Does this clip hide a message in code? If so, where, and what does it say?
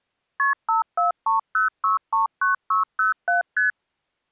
Yes: multi-frequency trunk signalling (R1, as on North American trunks) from 0.4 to 3.7 s, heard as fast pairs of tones, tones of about 140 ms. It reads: KP 5430639607 ST